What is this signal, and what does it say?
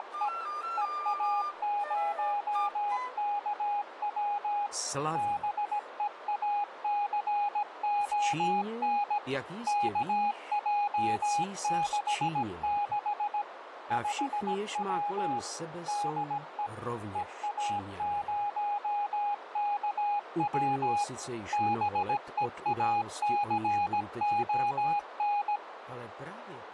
Morse code, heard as a keyed tone, machine-sent, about 17 wpm, 820 Hz, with radio static and a narrow filter. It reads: … EA0KW BEACON KJ66 5W DE EA0KW BEACON